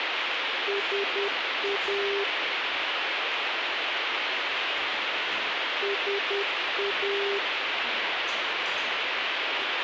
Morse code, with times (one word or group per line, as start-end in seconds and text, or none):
0.7-2.2 SA
5.8-7.4 SA